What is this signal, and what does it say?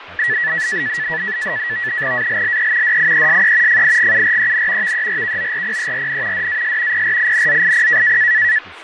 NAVTEX (SITOR-B), 100 baud, 170 Hz shift, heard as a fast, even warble, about 1850 Hz centre, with radio static, fading and speech in English. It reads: ALLE DIESE FIGUREN VERKORPERN DAS PRINZIP